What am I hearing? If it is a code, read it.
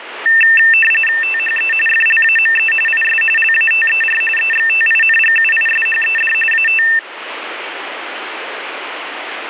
RTTY (45.45 baud, 850 Hz shift), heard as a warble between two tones, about 2250 Hz centre, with radio static. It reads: THE FLAME IS LATER EXTINGUISHED AT